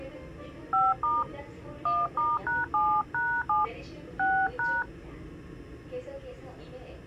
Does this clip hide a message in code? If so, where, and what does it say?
Yes: DTMF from 0.7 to 4.8 s, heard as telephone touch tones, dialled by hand, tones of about 210 ms, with the noise inside a subway train. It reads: 5* 1*#7#7 6#